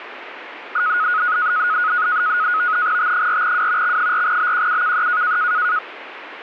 NAVTEX (SITOR-B), 100 baud, 170 Hz shift, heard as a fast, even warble, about 1360 Hz centre, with radio static. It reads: T4W X4BQUKE